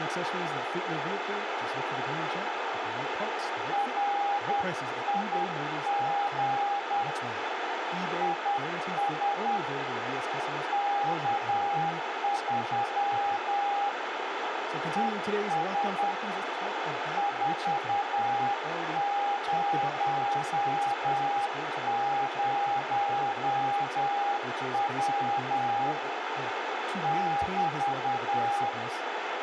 Morse code, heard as a keyed tone, hand-sent with a paddle, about 10 wpm, 810 Hz, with heavy radio static, a narrow filter and speech in English. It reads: RIG IS K3 ES 400W <BT>